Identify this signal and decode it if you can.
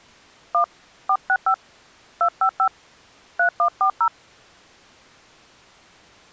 DTMF, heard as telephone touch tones, dialled by hand, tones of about 80 ms. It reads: 1 465 255 3140